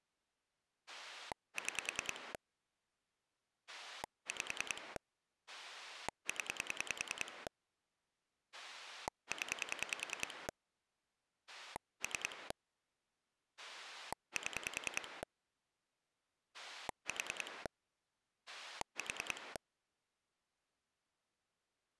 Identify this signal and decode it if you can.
Pulse dialling, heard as a rotary dial, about 10 pulses a second. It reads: 6 5 0 0 3 7 4 4